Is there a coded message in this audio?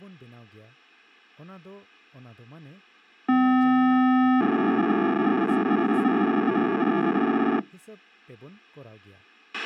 Yes: POCSAG pager data (512 baud) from 3.3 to 7.6 s, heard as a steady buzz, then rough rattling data, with a squelch burst at the end and speech in Santali.